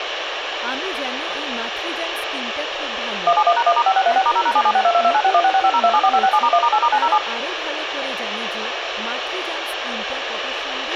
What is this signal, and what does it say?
DTMF, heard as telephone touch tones, dialled by machine, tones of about 60 ms, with radio hiss, a squelch burst at the end, room echo and speech in Bangla. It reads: 171#1*5636*0#7762229616650274567*1*8*907